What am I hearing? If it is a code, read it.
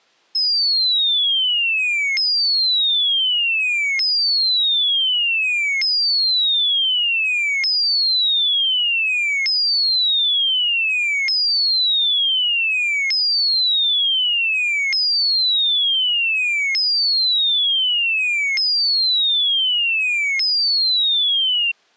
A tone that sweeps in pitch again and again. There is no code.